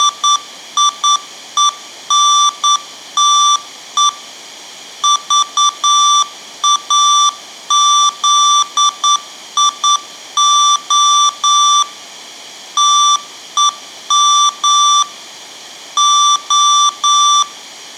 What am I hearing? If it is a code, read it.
Morse code, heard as electronic beeps, machine-sent, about 9 wpm, 1170 Hz, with room echo. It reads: … VAZIO TEM O